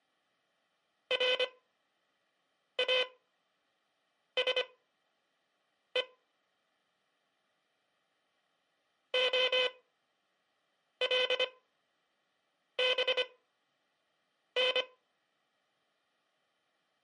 Morse code (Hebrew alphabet), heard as a buzzer, machine-sent, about 25 wpm, spaced as for 6 wpm. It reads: ראשו הלבן